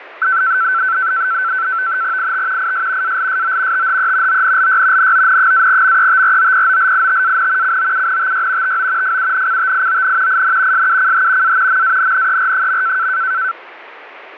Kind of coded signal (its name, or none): NAVTEX (SITOR-B)